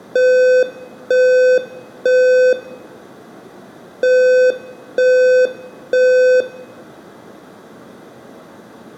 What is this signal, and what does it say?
Alarm pattern, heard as an alarm's beeps, played twice, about 510 Hz, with room echo. Temporal three. Smoke or fire, evacuate.